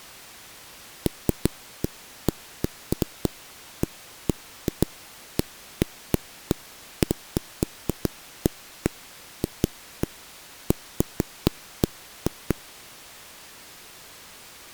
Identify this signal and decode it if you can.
Irregular knocks on a wall. There is no code.